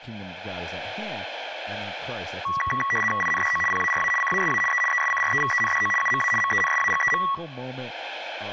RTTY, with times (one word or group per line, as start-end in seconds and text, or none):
3.2-3.6 INDO
3.7-4.1 PARA
4.2-4.6 CASA
4.7-4.8 E
4.9-5.9 ESCREVENDO
6.0-6.3 UMA
6.4-7.2 MENSAGEM